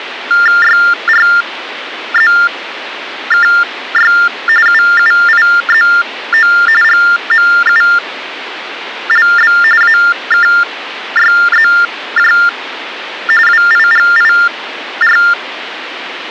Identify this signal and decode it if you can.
TTY/TDD text telephone tones (45.45 baud Baudot), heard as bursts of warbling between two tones, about 400 Hz shift, 1600 Hz centre, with phone line noise. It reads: YRZKY UUIZO GMULB AKYZJ WIGIR